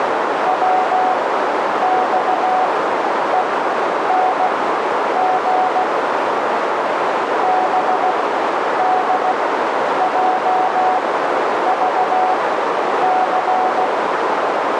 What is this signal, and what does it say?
Morse code, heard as a keyed tone, machine-sent, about 16 wpm, spaced as for 9 wpm, 740 Hz, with heavy radio static and a narrow filter. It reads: WXENG BDJVC